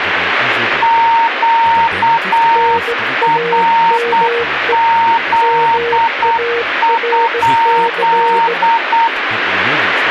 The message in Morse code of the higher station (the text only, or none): QRZ?